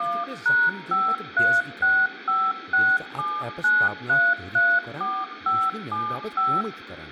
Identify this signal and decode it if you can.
DTMF, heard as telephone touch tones, dialled by machine, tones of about 240 ms, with phone line noise, room echo and speech in Kashmiri. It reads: 1#5365679334575